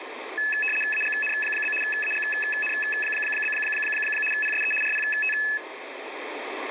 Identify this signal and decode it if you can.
RTTY (75 baud, 850 Hz shift), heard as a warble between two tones, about 2150 Hz centre, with radio static. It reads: AGN? AGN? PSE RPT